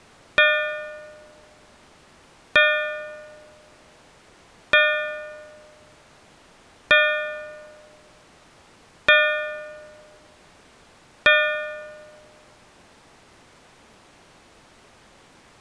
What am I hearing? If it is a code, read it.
Clock strike, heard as a bell. 6. Six o'clock.